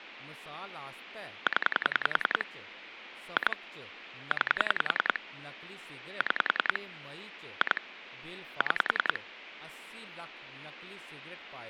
Pulse dialling, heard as clicks on a phone line, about 10 pulses a second, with phone line noise and speech in Dogri. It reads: 0 2 9 6 2 6